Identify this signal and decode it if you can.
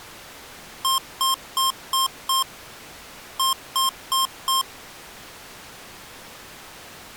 Beep code, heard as beeps from a small speaker, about 1060 Hz. 5-4.